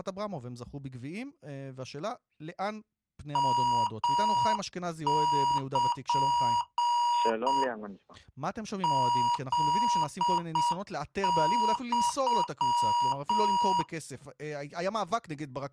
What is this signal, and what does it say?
Morse code (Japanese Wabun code), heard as electronic beeps, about 7 wpm, 960 Hz, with speech in Hebrew. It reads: ヨル フユ